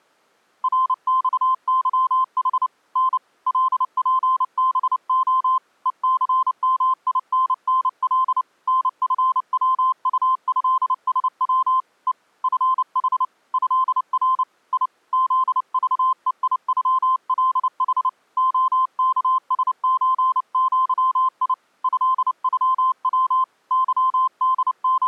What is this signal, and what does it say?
Morse code (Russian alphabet), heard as a keyed tone, hand-sent with a paddle, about 29 wpm, 1040 Hz. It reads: РЬЫХ Н ЛПБО ЕЦМИННЛ НФВУЭСВ Е ФХ ЭР И ЗЖЕИЮЛХ ОКСЧЪИ ЭЮВ …